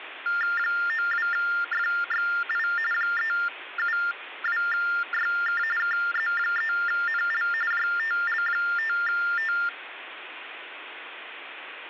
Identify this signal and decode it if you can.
TTY/TDD text telephone tones (45.45 baud Baudot), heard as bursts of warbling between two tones, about 400 Hz shift, 1600 Hz centre, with phone line noise. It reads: 92FXI 372YK KZ3NL JTL5T